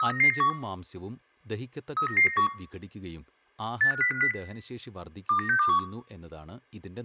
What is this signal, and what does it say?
Five-tone selective call (CCIR), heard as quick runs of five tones, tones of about 100 ms, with room echo and speech in Malayalam. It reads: 39991 39991 85050 29621